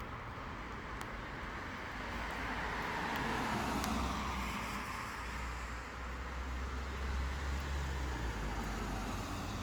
Street noise. There is no code.